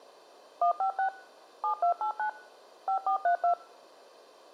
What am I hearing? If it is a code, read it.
DTMF, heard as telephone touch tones, dialled by machine, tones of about 100 ms. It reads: 156 7289 5432